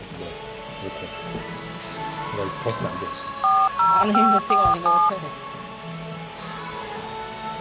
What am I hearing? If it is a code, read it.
DTMF, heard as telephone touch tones, dialled by machine, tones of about 240 ms, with the noise of a cafe. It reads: 40547